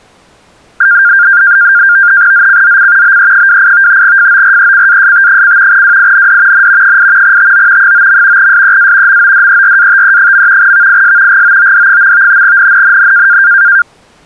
NAVTEX (SITOR-B), 100 baud, 170 Hz shift, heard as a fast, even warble, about 1500 Hz centre. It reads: ZCZC BE28 FORECAST: WIND N 8 TO 9. SEA MODERATE. VIS GOOD. NNNN